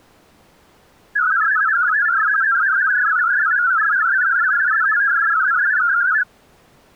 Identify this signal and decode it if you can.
Multi-tone FSK (Olivia or MFSK type), about 500 Hz wide, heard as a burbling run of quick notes, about 62.5 baud.